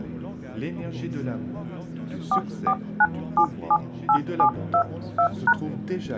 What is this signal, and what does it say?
DTMF, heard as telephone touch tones, dialled by hand, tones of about 70 ms. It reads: 449778722#